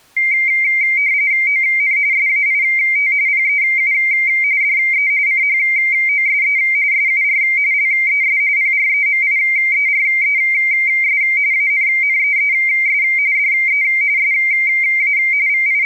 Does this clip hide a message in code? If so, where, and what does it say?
Yes: RTTY (45.45 baud, 170 Hz shift) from 0.2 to 15.9 s, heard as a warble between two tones, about 2200 Hz centre. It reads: ON SAIT PEU DE CHOSE SUR LES PREMIERES ANNEES DE SA …